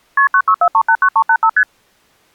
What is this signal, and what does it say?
Multi-frequency trunk signalling (R1, as on North American trunks), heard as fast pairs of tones, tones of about 70 ms. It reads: KP 964389385 ST